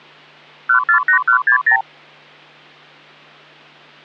Multi-frequency trunk signalling (R2, with the far end's replies), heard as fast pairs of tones, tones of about 100 ms. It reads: 148160